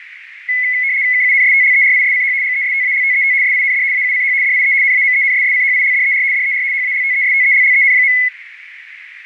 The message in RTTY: KUNSTLERISCH GESTALTET SIND AUCH DIE NAMENSSCHILDER DER HALTESTELLEN.

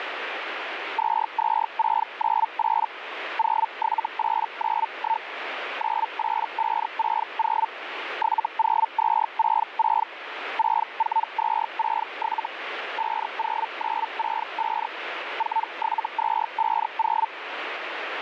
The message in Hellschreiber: 22698 07891 98560 70266 64267 50965 47250

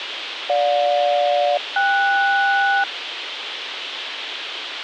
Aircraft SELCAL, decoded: GJ-KS

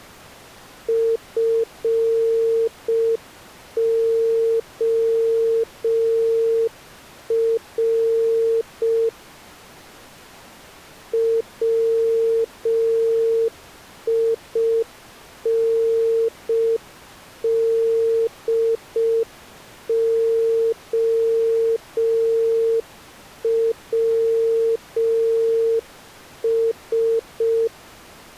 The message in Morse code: FOR WINDOWS

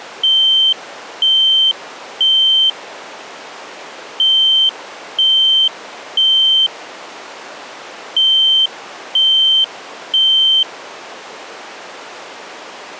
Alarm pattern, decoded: temporal three

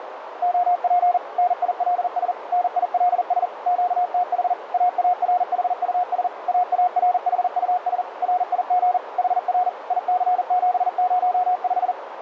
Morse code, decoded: OP NILS NILS QTH AARHUS AARHUS RIG HR IC705

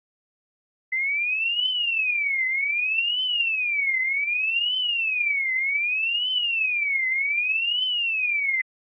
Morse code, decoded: none

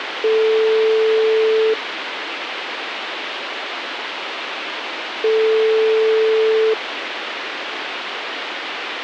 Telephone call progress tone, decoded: ringback tone

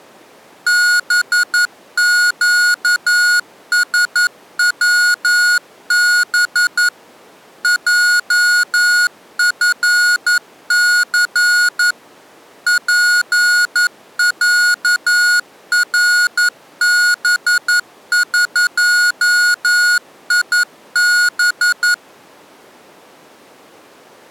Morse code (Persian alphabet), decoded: بگسوب جفث پصربقیب

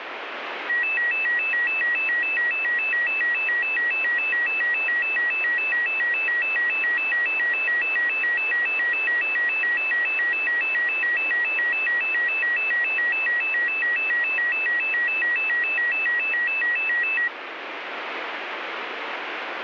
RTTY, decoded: none

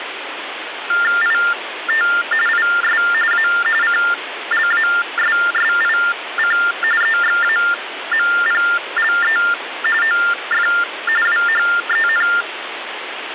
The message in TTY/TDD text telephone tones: IT IS A CLASSIC EXAMPLE OF WHEN

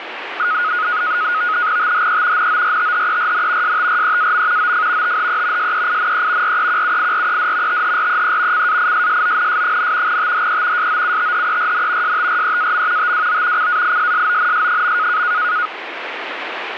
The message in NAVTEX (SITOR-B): THE NORTHERN STREAM OF THE SEINE REQUIRED THREE CAISSONS, THE SOUTHERN STREAM TWO CAISSONS.

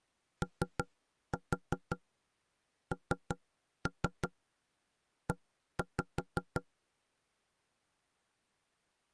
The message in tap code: ONE

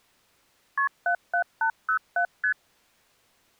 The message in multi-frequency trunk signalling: KP 77807 ST

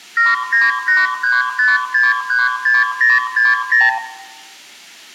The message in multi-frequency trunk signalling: 79835636060

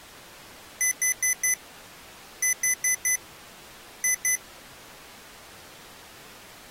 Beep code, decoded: 4-4-2

